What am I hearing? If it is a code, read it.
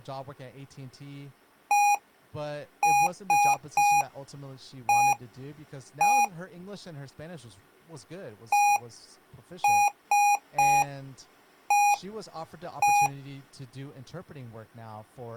Beep code, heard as beeps from a small speaker, played twice, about 820 Hz, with speech in English. 1-3-1-1. In Phoenix BIOS tables: memory refresh test failure.